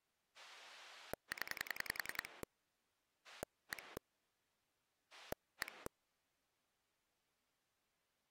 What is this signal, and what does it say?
Pulse dialling, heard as a rotary dial, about 10 pulses a second. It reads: 0 1 1